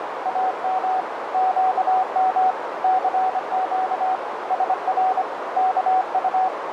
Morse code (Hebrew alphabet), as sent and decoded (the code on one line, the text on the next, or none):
.- -- / --.- -- / -.-. --.- / ... .-. / -.- ..-
אם קם סק שר כט